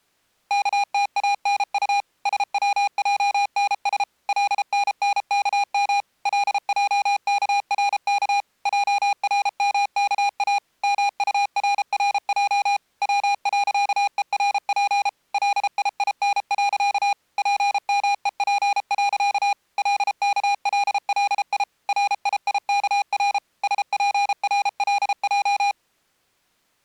Morse code, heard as electronic beeps, machine-sent, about 33 wpm, 810 Hz. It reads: KTANU SWJNS LNNKM LJKRK JRMKA MURRJ W.ERP LIIN. PMEP. LKLLI RIIKR SPRLJ